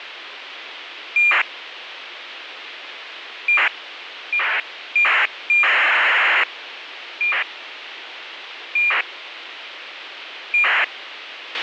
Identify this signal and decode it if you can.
ACARS aircraft data, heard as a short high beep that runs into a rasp, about 2400 baud, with radio hiss and a squelch burst at the end.